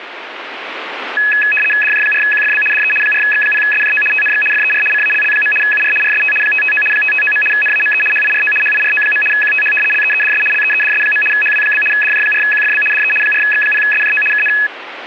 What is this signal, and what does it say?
RTTY (75 baud, 850 Hz shift), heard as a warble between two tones, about 2100 Hz centre, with radio static. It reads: DJ4QFB DE 4X0SJO TNX FER CALL. UR RST 559 559. NAME HIRO HIRO. QTH LEEDS LEEDS. HW? DJ4QFB DE 4X0SJO KN